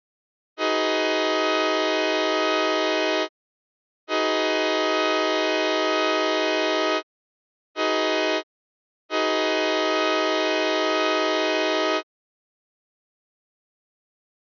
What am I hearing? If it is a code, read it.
Train horn signal, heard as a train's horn. 2 long, 1 short, 1 long. On North American railways: approaching a public crossing.